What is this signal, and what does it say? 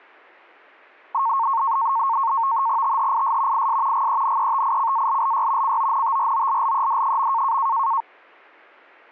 NAVTEX (SITOR-B), 100 baud, 170 Hz shift, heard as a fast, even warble, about 1000 Hz centre. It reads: THIS IS GENETICALLY CONTROLLED.